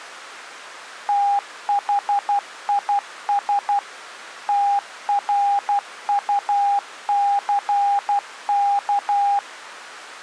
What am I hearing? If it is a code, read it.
Morse code, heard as a keyed tone, machine-sent, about 12 wpm, 810 Hz. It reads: THIS TRUCK